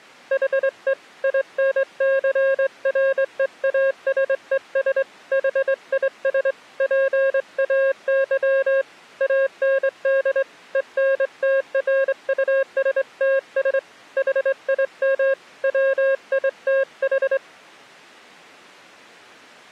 Morse code, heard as a keyed tone, hand-sent with a straight key, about 23 wpm, 540 Hz. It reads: HE INCREASES HIS PAY AND ENTRUSTS HIM WITH